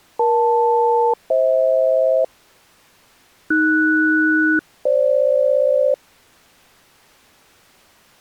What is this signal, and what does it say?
Aircraft SELCAL, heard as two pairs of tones. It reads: EL-FH AS-FG